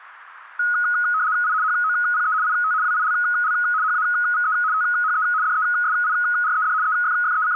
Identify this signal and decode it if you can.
RTTY (75 baud, 170 Hz shift), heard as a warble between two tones, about 1360 Hz centre. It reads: I HOPE IT WILL HAVE THE DESIRED …